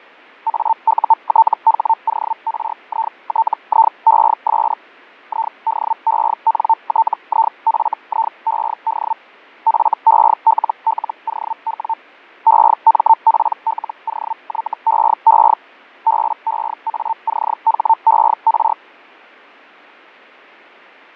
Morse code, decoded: none

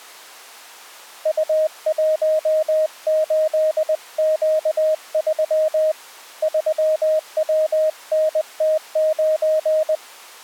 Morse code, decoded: U18Q3 3WNT9

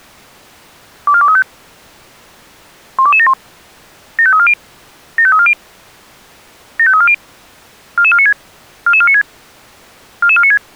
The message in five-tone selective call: 24235 12271 75340 75340 75340 44496 44496 44496

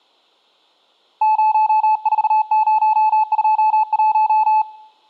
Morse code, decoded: 04021

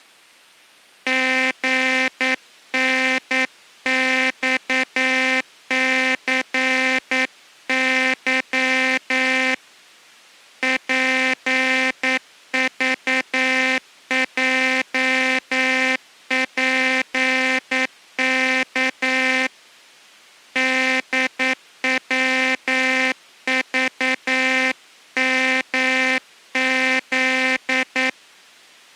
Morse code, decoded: GNXCY PVJPK DWVMZ

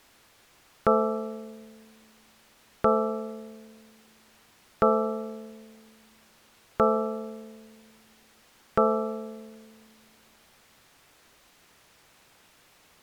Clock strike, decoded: 5

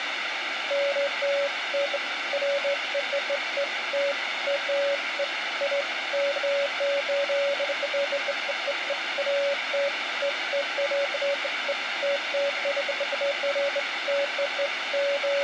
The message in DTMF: none

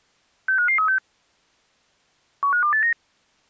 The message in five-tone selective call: 65536 15289

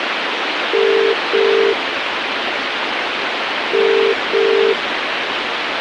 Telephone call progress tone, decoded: ringback tone

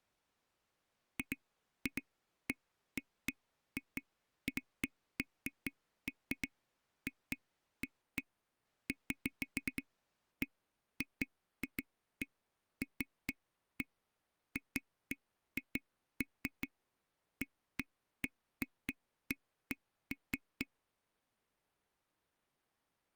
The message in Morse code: none

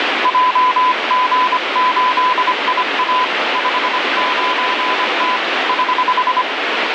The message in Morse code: JG8IA 59T <HH>

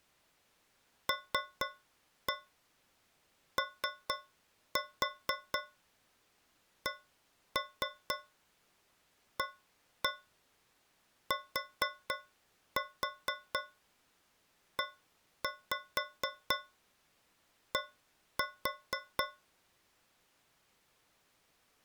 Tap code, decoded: LOCATED

